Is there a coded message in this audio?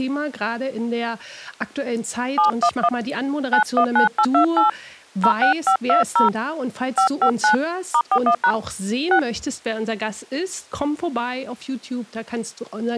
Yes: DTMF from 2.4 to 9.2 s, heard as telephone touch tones, dialled by hand, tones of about 90 ms. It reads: 711 919828 06520 559 *41# 6